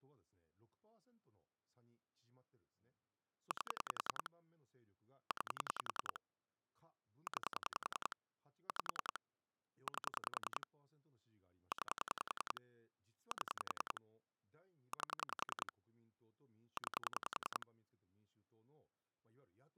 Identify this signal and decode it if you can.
Pulse dialling, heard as clicks on a phone line, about 10 pulses a second, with speech in Japanese. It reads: 8 9 9 5 8 9 7 8 9